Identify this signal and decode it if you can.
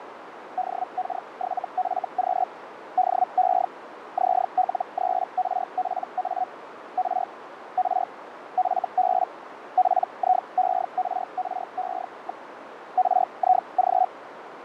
Hellschreiber (Feld-Hell, 122.5 baud), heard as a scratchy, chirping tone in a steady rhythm, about 740 Hz, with radio static, fading and a narrow filter. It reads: DK7FQ DE ZL3RPA R R FB PIERRE. RIG